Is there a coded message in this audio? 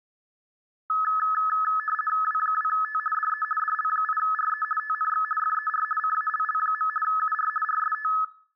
Yes: RTTY (50 baud, 450 Hz shift) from 0.9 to 8.2 s, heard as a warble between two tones, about 1500 Hz centre. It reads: W2T DE DL8RE TNX FER CALL. UR RST